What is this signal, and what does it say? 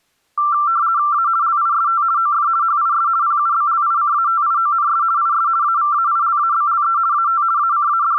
RTTY (50 baud, 170 Hz shift), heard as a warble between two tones, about 1260 Hz centre. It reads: A LIST OF HIS PUBLICATIONS IS AVAILABLE AT …